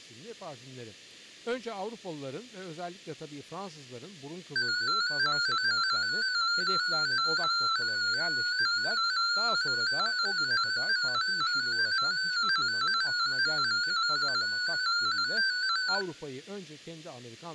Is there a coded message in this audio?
Yes: multi-tone FSK (Olivia or MFSK type), about 250 Hz wide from 4.6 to 16.0 s, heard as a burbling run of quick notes, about 15.625 baud, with room echo and speech in Turkish.